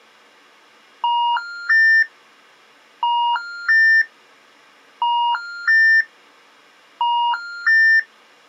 Telephone call progress tone (ITU plan), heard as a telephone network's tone, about 950, 1400, 1800 Hz. Special information tone.